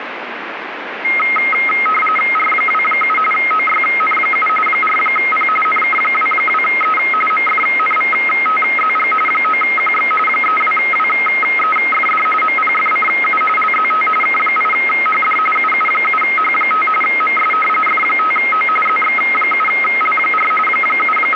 RTTY (45.45 baud, 850 Hz shift), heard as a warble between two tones, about 1700 Hz centre, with radio static. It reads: R27 OYN7 4P NK22E MFNVTZG 9QX 32WEFD MPFCU LZT K8HD UU7H5 MS F5O ZX7L4 …